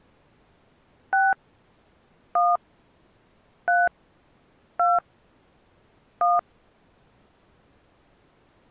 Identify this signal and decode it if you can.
DTMF, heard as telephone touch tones, dialled by hand, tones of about 220 ms. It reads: 6 1 3 2 1